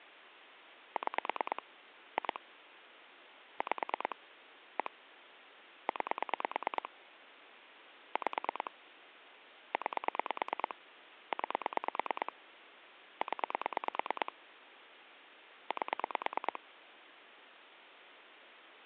Pulse dialling, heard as clicks on a phone line, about 9 pulses a second, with phone line noise. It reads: 6 2 5 1 9 5 9 9 0 8